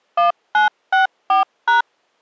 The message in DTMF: 1964#

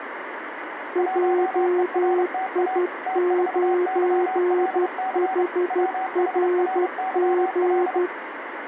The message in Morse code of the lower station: JI9HRG

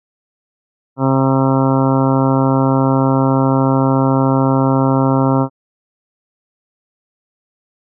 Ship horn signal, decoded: 1 long

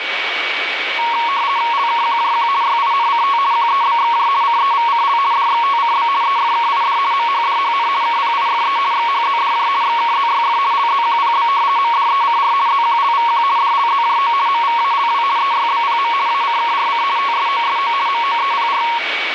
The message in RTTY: LKQJQ YINCT QEBXJ CEVCL DXTCB EFKID MHDHN KPIFE XHZDJ XKZYF LZQPB MDECR ZQLVQ DLZJO MVALW EYBPM ACKRC TSOSO MOEPR

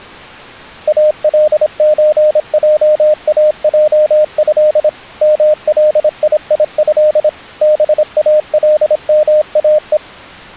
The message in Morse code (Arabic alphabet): الزجاجه ملييه بالماء

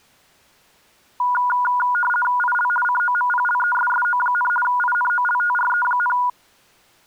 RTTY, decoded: IL COMPLESSO, INOLTRE,

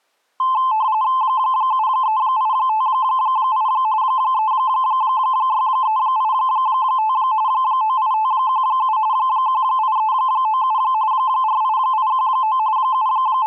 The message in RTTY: 73858 36385 98517 18397 48819 …

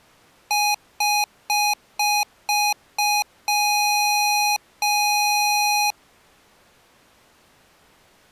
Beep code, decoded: 6 short, 2 long

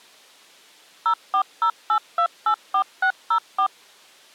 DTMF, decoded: 0408284604

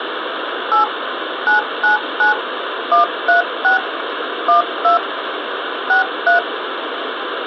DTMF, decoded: 8 999 136 12 63

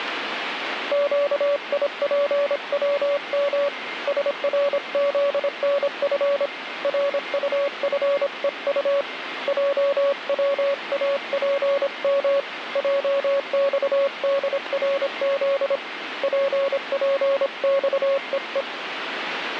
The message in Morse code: QIPWM SRZNF RUFEU JWAPM JXDRZ PPXEE

